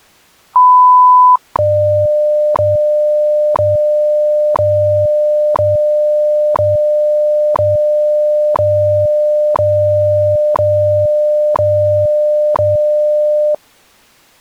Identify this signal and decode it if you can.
Radio time signal (WWV, Colorado), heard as ticks, one a second.